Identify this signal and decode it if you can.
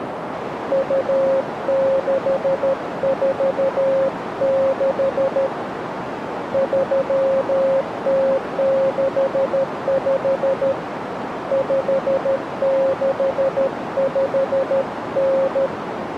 Morse code (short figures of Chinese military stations), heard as a keyed tone, hand-sent with a paddle, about 13 wpm, 540 Hz, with radio static and a narrow filter. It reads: 2646 3065 5659